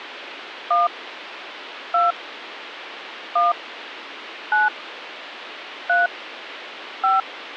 DTMF, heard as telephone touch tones, dialled by hand, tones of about 170 ms, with phone line noise. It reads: 1 2 1 9 3 5